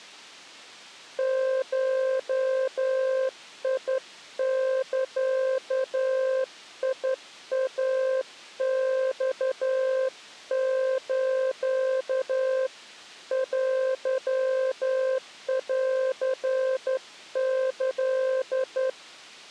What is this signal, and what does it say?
Morse code (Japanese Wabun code), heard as a keyed tone, hand-sent with a straight key, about 11 wpm, 520 Hz. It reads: ゴザイマス テンキ